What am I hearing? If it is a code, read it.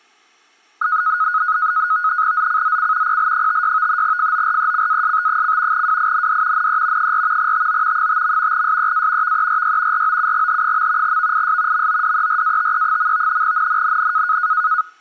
NAVTEX (SITOR-B), 100 baud, 170 Hz shift, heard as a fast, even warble, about 1360 Hz centre. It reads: ZCZC PL56 FORECAST: WIND NE 4 TO 5. SEA VERY ROUGH. VIS MODERATE. NNNN